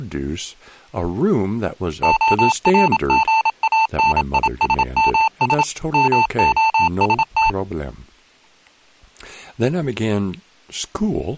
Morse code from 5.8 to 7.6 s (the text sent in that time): MOST